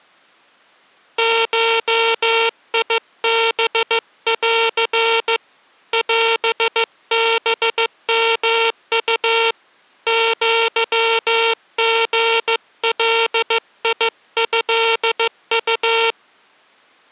Morse code (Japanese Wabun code), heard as a buzzer, hand-sent with a paddle, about 15 wpm. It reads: ゴハン オハヨウ アリガトウ